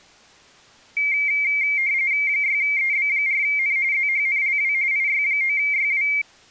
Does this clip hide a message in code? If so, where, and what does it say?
Yes: RTTY (45.45 baud, 170 Hz shift) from 1.0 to 6.2 s, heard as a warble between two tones, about 2200 Hz centre. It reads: 6EB4N ZHNLW IY9YW